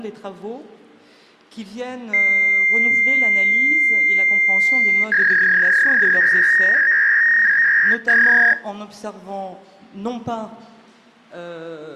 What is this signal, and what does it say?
Fax machine handshake, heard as a long tone and a warble.